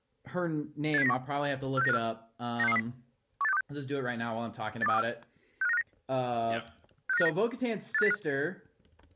Five-tone selective call (EEA), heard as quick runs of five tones, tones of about 40 ms, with speech in English. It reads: 87091 46954 96630 18626 82324 65959 65959 85805